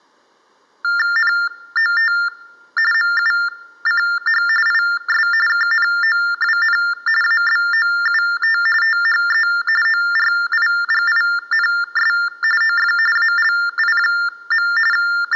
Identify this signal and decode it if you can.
TTY/TDD text telephone tones (45.45 baud Baudot), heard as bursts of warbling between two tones, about 400 Hz shift, 1600 Hz centre. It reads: NOT MUCH IS KNOWN ABOUT THE ORIGINS OF ALI. …